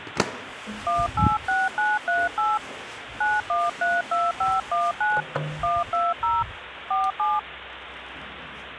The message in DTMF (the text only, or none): 186938 9132519 120 47